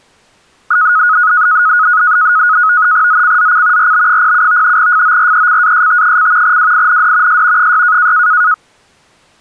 NAVTEX (SITOR-B), 100 baud, 170 Hz shift, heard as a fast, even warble, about 1360 Hz centre. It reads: ZCZC RB07 FORECAST: WIND S 6